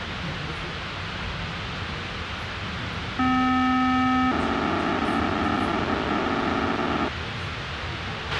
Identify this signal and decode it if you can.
POCSAG pager data (512 baud), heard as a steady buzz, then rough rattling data, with radio hiss, a squelch burst at the end and the noise inside a subway train.